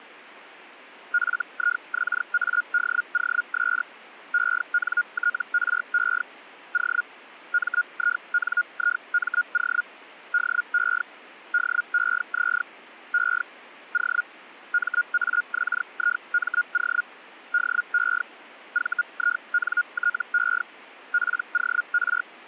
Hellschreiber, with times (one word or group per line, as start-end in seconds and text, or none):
1.1-3.8 FIXADOS
4.3-6.2 ENTRE
6.7-7.0 O
7.5-9.8 MINIMO
10.3-11.0 DE
11.5-12.6 DEZ
13.1-13.4 E
13.9-14.2 O
14.7-17.0 MAXIMO
17.5-18.2 DE
18.7-20.6 VINTE
21.1-22.2 POR